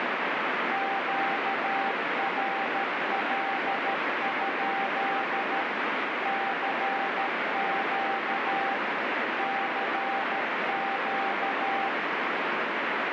Morse code, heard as a keyed tone, machine-sent, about 13 wpm, 780 Hz, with heavy radio static. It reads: QRL? CQ CQ